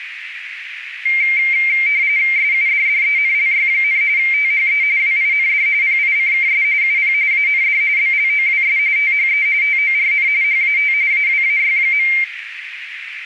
RTTY (45.45 baud, 170 Hz shift), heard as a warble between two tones, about 2200 Hz centre, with radio static and a narrow filter. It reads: SUDDENLY, THE WIND PICKS UP AND BLOWS THE TORN HAT AWAY.